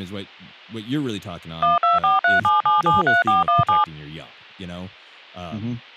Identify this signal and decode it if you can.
DTMF, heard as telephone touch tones, dialled by machine, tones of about 160 ms, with speech in English. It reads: 12437773417